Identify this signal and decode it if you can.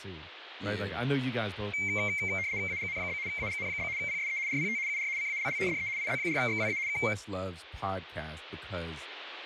RTTY (75 baud, 170 Hz shift), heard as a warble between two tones, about 2200 Hz centre, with radio static and speech in English. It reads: AGN? AGN? PSE RPT UR CALL DE IZ4XWA K